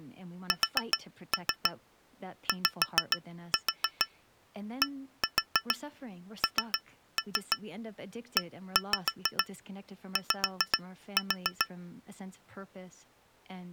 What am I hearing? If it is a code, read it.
Tap code, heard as taps on glass, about 6 knocks a second, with speech in English. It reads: SYDNEY